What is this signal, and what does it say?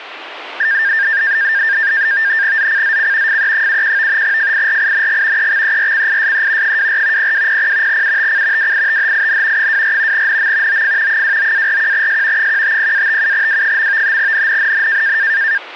NAVTEX (SITOR-B), 100 baud, 170 Hz shift, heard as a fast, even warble, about 1700 Hz centre. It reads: ZCZC FE71 FIRING EXERCISE 24 0200 UTC WITHIN 24 NM OF 29-41S 150-57W. NNNN